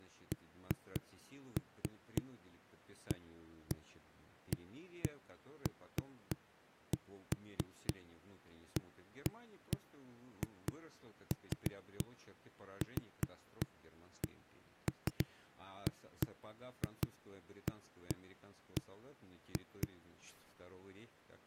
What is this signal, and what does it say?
Irregular knocks on a wall, with speech in Russian. There is no code.